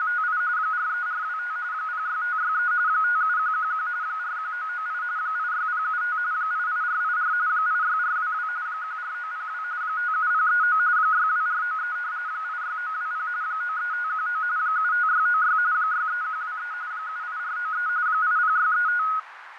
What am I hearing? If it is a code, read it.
RTTY (45.45 baud, 170 Hz shift), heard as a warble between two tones, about 1360 Hz centre, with radio static, fading and a narrow filter. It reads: … 43425 06563 57111 41998 86075 88484 86422 14902 57039 62493 86920 93519 75696 63123 78493 80635